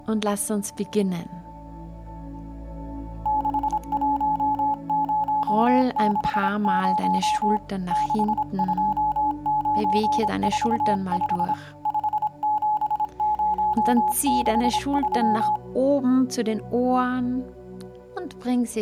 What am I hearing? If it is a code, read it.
Morse code, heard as a keyed tone, hand-sent with a paddle, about 26 wpm, 850 Hz. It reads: 61060 62945 57063